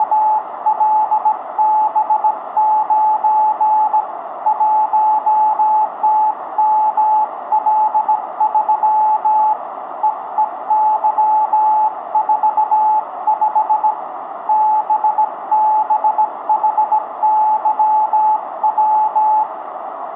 Morse code, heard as a keyed tone, hand-sent with a bug key, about 17 wpm, 860 Hz, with radio static, a narrow filter and room echo. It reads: … 1TML3 EEY45 BBHYW